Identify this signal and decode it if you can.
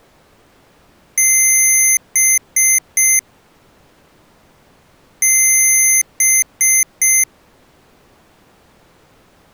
Beep code, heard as beeps from a small speaker, played twice, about 2100 Hz. 1 long, 3 short. In Award and IBM BIOS tables: video adapter failure; in AMI BIOS tables: memory failure.